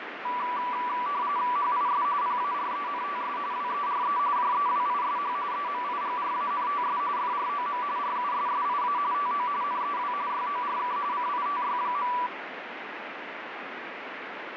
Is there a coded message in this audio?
Yes: RTTY (45.45 baud, 170 Hz shift) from 0.2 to 12.3 s, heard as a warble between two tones, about 1070 Hz centre, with radio static. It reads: HIS PARENTS WERE JEWISH EMIGRANTS FROM RUSSIA TO NEW YORK CITY.